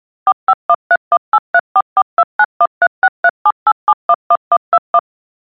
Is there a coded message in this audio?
Yes: DTMF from 0.3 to 5.0 s, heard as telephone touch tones, dialled by machine, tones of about 50 ms. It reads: 45131834429136378711121